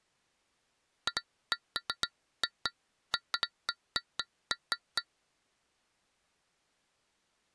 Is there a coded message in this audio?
No, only irregular taps on glass.